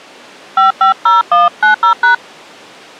DTMF, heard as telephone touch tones, dialled by hand, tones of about 130 ms. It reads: 550190#